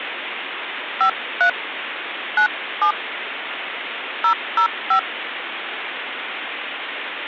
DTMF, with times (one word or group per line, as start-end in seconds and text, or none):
1.0-1.5 53
2.4-2.9 97
4.2-5.0 005